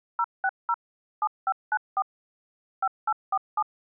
DTMF, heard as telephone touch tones, dialled by machine, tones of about 50 ms. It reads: 060 7594 5847